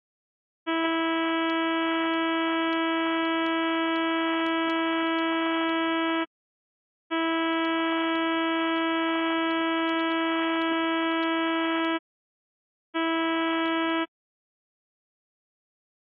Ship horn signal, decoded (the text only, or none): 2 long, 1 short